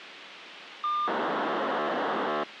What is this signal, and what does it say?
POCSAG pager data (2400 baud), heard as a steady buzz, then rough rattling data, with radio hiss.